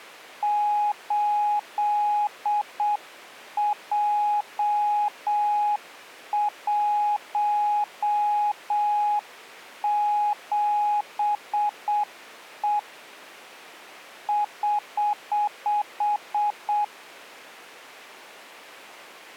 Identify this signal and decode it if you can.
Morse code, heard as a keyed tone, hand-sent with a paddle, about 7 wpm, 830 Hz. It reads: 8J17E <HH>